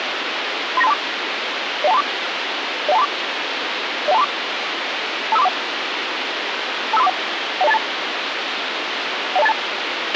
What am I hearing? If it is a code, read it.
Five-tone selective call (EIA), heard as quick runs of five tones, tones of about 30 ms, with radio hiss and a squelch burst at the end. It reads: 39324 01234 01234 01234 25341 25341 10282 10282